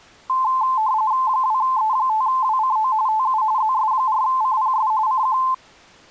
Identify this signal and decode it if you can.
RTTY (45.45 baud, 170 Hz shift), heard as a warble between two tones, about 960 Hz centre. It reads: 2E5WCO TU ZS4CPS CQ